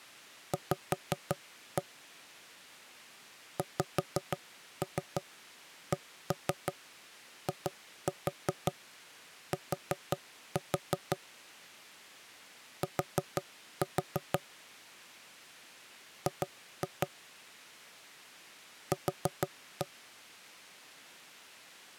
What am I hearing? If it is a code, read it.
Tap code, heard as knocks on wood, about 5 knocks a second. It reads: V XCIT T G Q